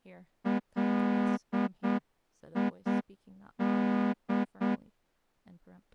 Morse code, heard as a horn, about 8 wpm, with speech in English. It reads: LID